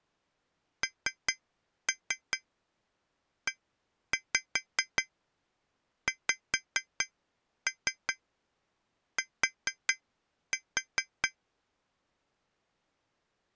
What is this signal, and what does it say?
Tap code, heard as taps on glass, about 4 knocks a second. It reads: NEXT